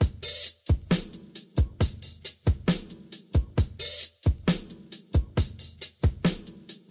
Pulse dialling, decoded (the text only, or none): none